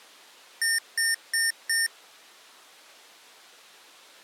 Beep code, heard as beeps from a small speaker, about 1800 Hz. 4 short. In AMI BIOS tables: system timer failure; in Dell tables: memory read or write failure.